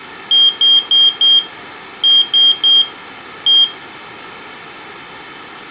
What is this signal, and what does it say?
Beep code, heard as a piezo beeper, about 3200 Hz, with room echo. 4-3-1. In Phoenix BIOS tables: memory failure above the first 64 KB.